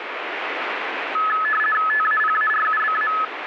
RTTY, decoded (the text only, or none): TAPARUBA